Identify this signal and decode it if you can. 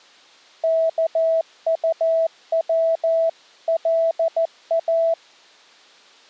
Morse code (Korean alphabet), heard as a keyed tone, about 14 wpm, 660 Hz. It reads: 입고